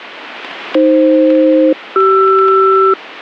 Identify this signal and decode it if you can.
Aircraft SELCAL, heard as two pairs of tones. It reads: AF-CR